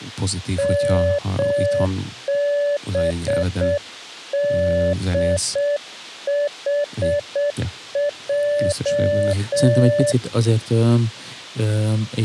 Morse code, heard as a keyed tone, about 7 wpm, 580 Hz, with speech in Hungarian. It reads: MBDHJ